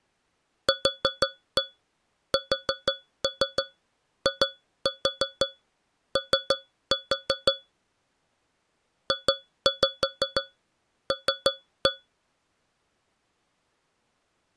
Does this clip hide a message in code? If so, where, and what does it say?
Yes: tap code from 0.7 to 12.1 s, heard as taps on a metal pipe, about 6 knocks a second. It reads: QSIO JL